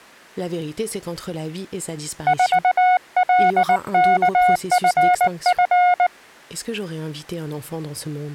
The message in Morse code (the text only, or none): 4LKFF